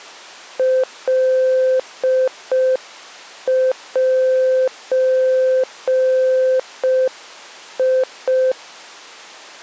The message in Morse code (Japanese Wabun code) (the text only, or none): カゼ